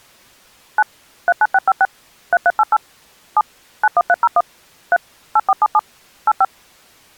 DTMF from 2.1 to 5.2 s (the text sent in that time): 3388 7 91301 3